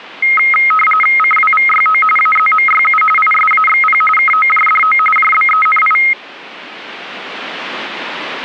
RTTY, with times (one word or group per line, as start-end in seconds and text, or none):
1.2-2.0 CWVYO
2.2-3.0 AZMYU
3.2-4.0 ISAXP
4.2-5.0 KOJDO
5.2-6.0 JBENI